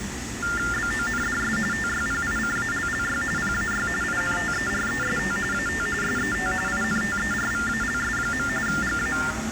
TTY/TDD text telephone tones (45.45 baud Baudot), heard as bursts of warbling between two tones, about 400 Hz shift, 1600 Hz centre, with phone line noise and the noise of a cafe. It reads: BONDS TYPICALLY PAY INTEREST AT SET INTERVALS. GA